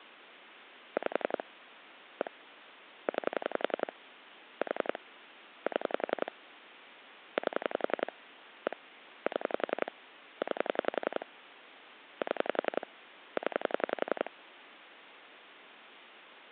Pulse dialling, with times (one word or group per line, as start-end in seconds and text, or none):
1.0-1.4 5
2.2-2.3 1
3.1-3.9 9
4.6-5.0 4
5.7-6.3 7
7.4-8.1 8
8.7-8.8 1
9.3-9.9 7
10.4-11.3 9
12.2-12.9 7
13.4-14.3 0